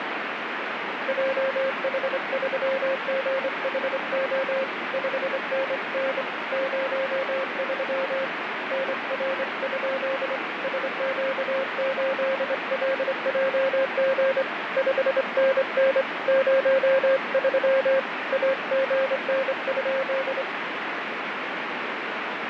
Morse code, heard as a keyed tone, hand-sent with a straight key, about 25 wpm, 540 Hz, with heavy radio static and fading. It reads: JH3GHO 5NN 03 NR? SQ8LJG 5NN 03 AGN?